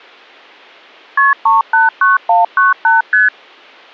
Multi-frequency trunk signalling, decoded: KP 389198 ST

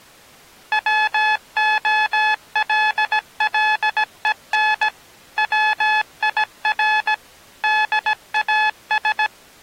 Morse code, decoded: WOLLEN WIR DAS

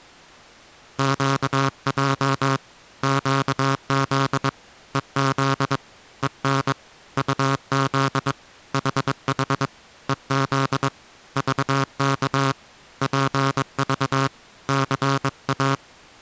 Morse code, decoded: QJ QZ EZ EN UZ HH EZ VK PV CA

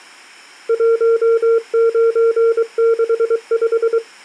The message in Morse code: 1965

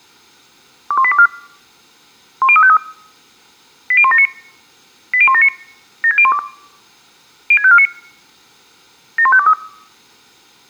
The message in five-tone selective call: 21824 10353 80179 80179 76012 06549 71523

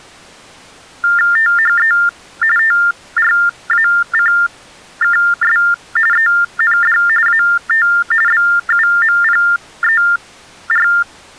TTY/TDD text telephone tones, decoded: THE TRACKS END AT BUMPER

